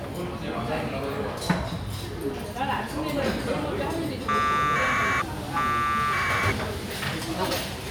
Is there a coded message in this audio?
Yes: packet radio (AX.25, as in APRS), 1200 baud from 4.3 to 6.5 s, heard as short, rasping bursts, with the noise of a restaurant.